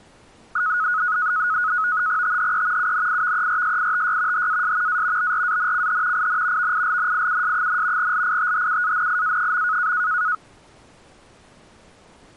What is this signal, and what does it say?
NAVTEX (SITOR-B), 100 baud, 170 Hz shift, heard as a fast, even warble, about 1360 Hz centre. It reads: THE UNIVERSITY HAS A BRANCH IN VILNIUS, LITHUANIA.